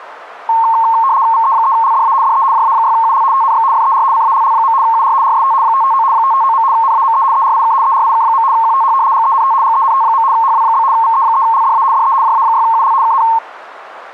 RTTY (75 baud, 170 Hz shift), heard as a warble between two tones, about 990 Hz centre, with radio static. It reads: VE3LDA DE JA6UL TNX FER CALL. UR RST 559 559. NAME ERIK ERIK. QTH GENT GENT. HW? VE3LDA DE JA6UL KN